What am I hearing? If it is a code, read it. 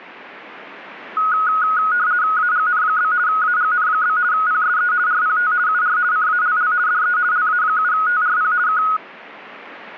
RTTY (50 baud, 170 Hz shift), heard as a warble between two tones, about 1360 Hz centre. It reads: AGN? AGN? PSE RPT UR CALL DE LA7TRP K